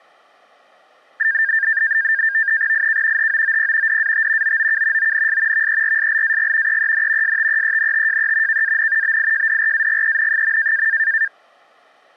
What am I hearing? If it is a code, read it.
NAVTEX (SITOR-B), 100 baud, 170 Hz shift, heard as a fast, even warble, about 1700 Hz centre. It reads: IK HOOP DAT OOK ONS VERSLAG EEN STEENTJE KAN BIJDRAGEN.